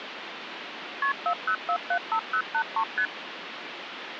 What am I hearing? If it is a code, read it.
Multi-frequency trunk signalling (R1, as on North American trunks), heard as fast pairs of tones, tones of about 80 ms, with phone line noise. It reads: KP 40475083 ST